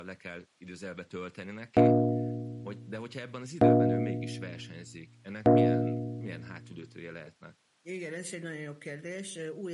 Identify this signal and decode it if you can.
Clock strike, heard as a bell, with speech in Hungarian. 3. Three o'clock.